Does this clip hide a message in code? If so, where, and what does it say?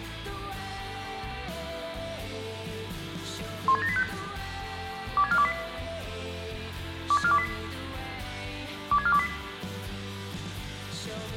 Yes: five-tone selective call (ZVEI) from 3.7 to 9.3 s, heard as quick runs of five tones, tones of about 70 ms. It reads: 16785 26428 26428 26428